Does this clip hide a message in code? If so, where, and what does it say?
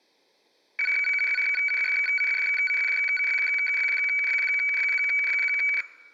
Yes: weather fax (radiofax), 120 lines a minute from 0.8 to 5.8 s, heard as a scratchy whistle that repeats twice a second.